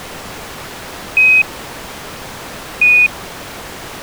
Quindar tones, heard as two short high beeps.